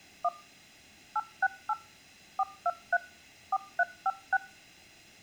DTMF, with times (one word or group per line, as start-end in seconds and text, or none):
0.2-0.3 1
1.2-1.7 868
2.4-3.0 423
3.5-4.4 4356